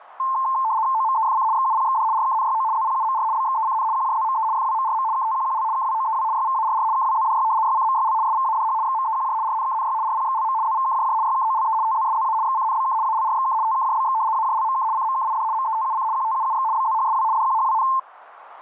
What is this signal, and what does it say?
RTTY (75 baud, 170 Hz shift), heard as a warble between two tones, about 970 Hz centre, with radio static. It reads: OMEFC XUPXD RKNYO ZPUMR BXECN QJZME FWMRM KTQQL KWOEW YVARR KWZDY YCMYL SVADH XMEQJ RNKNY RPXLM ZVKJJ YKOLE TZSZA XCNBK ALRXK TKJBX AJLMK CMKID METUC QTUUX BZHSW DQHWN